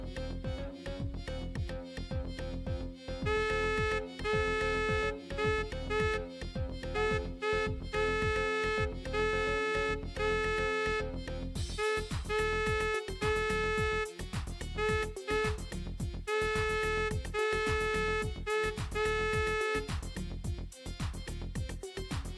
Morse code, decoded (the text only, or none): Z2WIQ